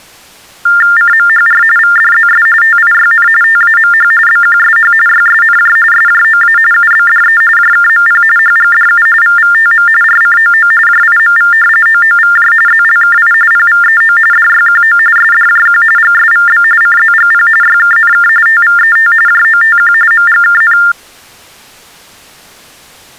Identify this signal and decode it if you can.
TTY/TDD text telephone tones (45.45 baud Baudot), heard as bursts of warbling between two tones, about 400 Hz shift, 1600 Hz centre. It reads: CMHR VDZS TIYN TAMH BQSH YSNJ SJOA UBDE JKMP HGDU VVTM RCOO JIMV OOVJ ZLKI PVEO DYQO SDJQ GSVB CZGP YKNK TVET JOTQ MGKN